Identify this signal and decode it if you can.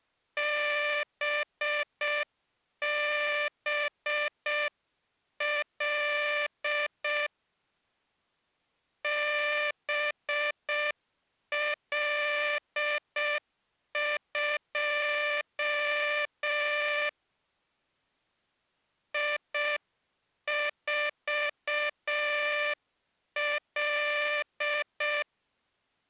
Morse code, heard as a buzzer, hand-sent with a paddle, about 6 wpm. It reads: BBL BL2 I4L